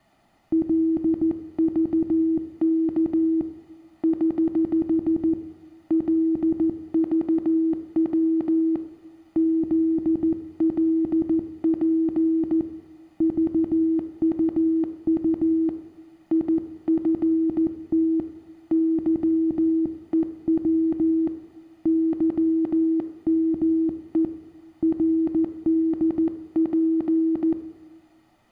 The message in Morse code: LVK <HH> LVW ZLP VUU IFT YEW YME RDP

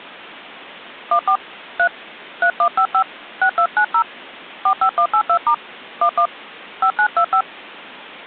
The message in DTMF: 14 3 3155 6290 45182* 11 5925

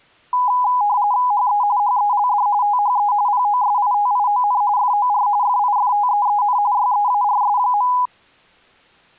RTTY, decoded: HE HELD THE POSITION FOR FIFTEEN YEARS.

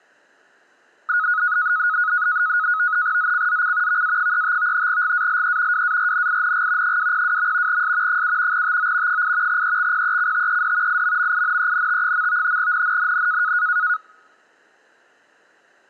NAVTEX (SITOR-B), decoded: ZCZC VA35 GALE WARNING 202. S 7 TO 8 EXPECTED IMMINENT. NNNN

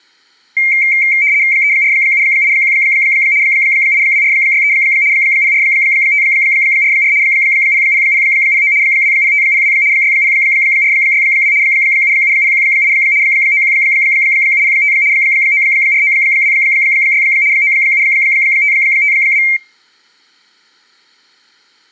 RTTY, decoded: 34781 82463 04544 00009 20502 60462 77018 91705 94926 97552

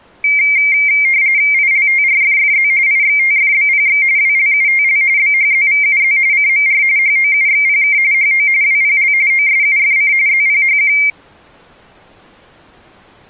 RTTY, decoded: ILTRFFZ IXTFBPX WLUTL BHZVUZ CMR HOUXPK HO WPL OSUFC ZPHQ

